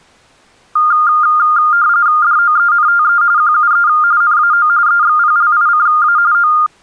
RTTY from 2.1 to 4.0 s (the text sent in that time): DOENTE QUE